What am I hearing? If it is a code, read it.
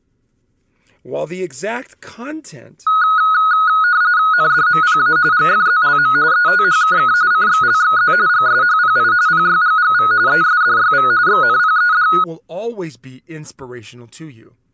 RTTY (45.45 baud, 170 Hz shift), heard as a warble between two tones, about 1360 Hz centre, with speech in English. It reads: NDMPA GFZLM ETHKK CXLXZ GSHPI PYGGV ESDYV XNPED